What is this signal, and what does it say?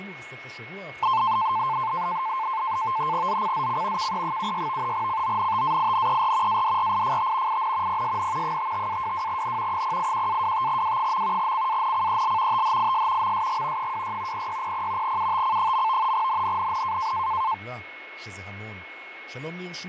NAVTEX (SITOR-B), 100 baud, 170 Hz shift, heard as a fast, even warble, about 970 Hz centre, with radio static, fading, a steady whistle near 2180 Hz and speech in Hebrew. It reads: ZCZC KE76 CONTAINER ADRIFT IN PSN 55-22N 081-25W. CANCEL THIS MSG 26 0600 UTC. NNNN